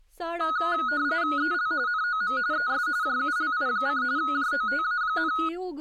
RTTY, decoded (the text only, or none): EL NOM ES JULI: JOTA,